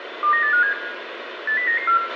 Five-tone selective call (CCIR), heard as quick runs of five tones, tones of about 100 ms, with radio hiss, a squelch burst at the end and room echo. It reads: 29857 80994